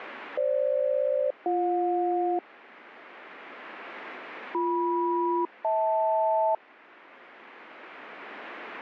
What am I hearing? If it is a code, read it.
Aircraft SELCAL, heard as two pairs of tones. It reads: FG-BJ BM-HL